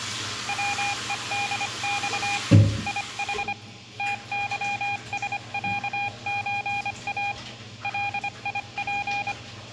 Morse code (Russian alphabet), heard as a keyed tone, hand-sent with a paddle, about 25 wpm, 810 Hz, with room echo and the noise of a restroom. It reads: ВЕДЬ ИХ ТЫСЯЧА ЛИП